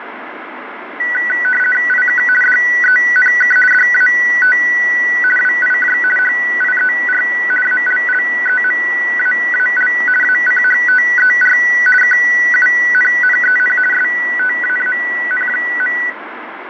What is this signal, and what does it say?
RTTY (50 baud, 450 Hz shift), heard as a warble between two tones, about 1700 Hz centre, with radio static. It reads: IK DENK DAT WIJ HIER ALLEMAAL ACHTER KUNNEN STAAN.